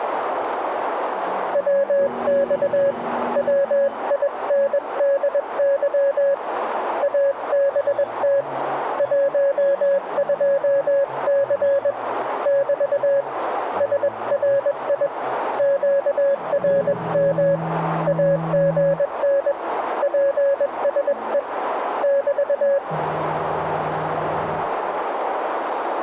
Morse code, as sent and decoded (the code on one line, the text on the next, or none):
.-- -..- / .-- .. -. -.. -.-- / .- -... - / .---- ..--- -.-. / -...- / ... .-. .. / --.- .-. -- / .- --. -. / .--. ... . / -...-
WX WINDY ABT 12C <BT> SRI QRM AGN PSE <BT>